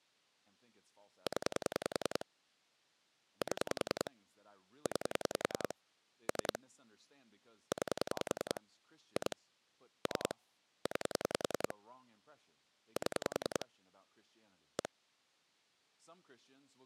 Pulse dialling, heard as clicks on a phone line, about 10 pulses a second, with speech in English. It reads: 0 7 9 3 9 2 3 9 7 1